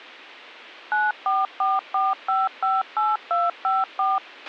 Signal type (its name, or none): DTMF